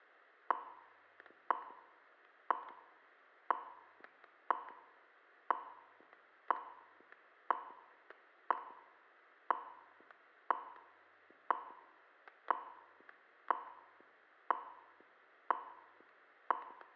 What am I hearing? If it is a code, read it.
Radio time signal (WWV, Colorado), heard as ticks, one a second, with static crashes and room echo.